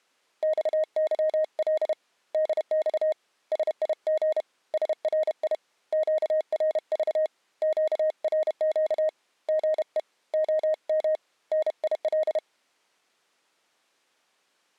Morse code, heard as a keyed tone, hand-sent with a paddle, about 31 wpm, 620 Hz. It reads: XYL DX SIG SRI QRV QRQ GE OM NIL